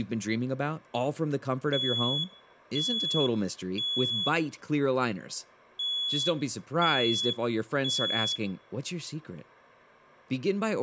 Alarm pattern, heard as an alarm's beeps, played twice, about 3400 Hz, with room echo and speech in English. Temporal three. Smoke or fire, evacuate.